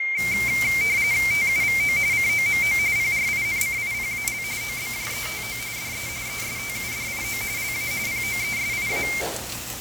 RTTY (45.45 baud, 170 Hz shift), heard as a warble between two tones, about 2200 Hz centre, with radio static, fading and the noise of a restaurant. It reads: TUVO COMO PRINCIPAL OBJETO DE ESTUDIO LA POESIA